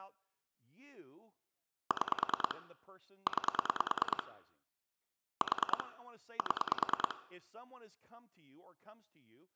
Pulse dialling, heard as clicks on a phone line, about 9 pulses a second, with speech in English. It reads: 6 9 4 7